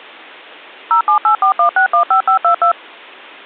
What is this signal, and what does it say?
DTMF, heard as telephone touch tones, dialled by machine, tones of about 100 ms. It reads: 07841615522